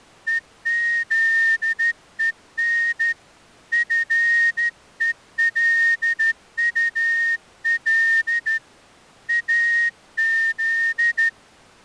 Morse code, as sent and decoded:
. --.. . -. / ..-. . .-.. ..- .-.. / .- --..
EZEN FELUL AZ

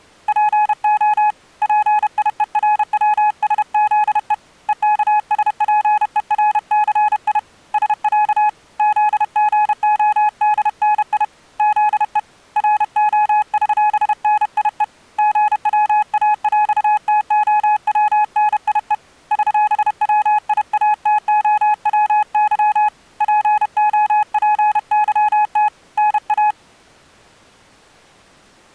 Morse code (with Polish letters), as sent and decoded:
.--. --- / .--. .. . .-. .-- ... --.. . / . -.- ... .--. . .-. -.-. .. / ... .-.- / --.. --. --- -.. -. .. / --.. . / .-. --- ...-... -. .. . / --. .-- .- .-..- - --- .-- -. .. . / ...-... .-- .. .- - --- .-- -.-- / .--. --- .--. -.-- - / -. .-
PO PIERWSZE EKSPERCI SĄ ZGODNI ZE ROŚNIE GWAŁTOWNIE ŚWIATOWY POPYT NA

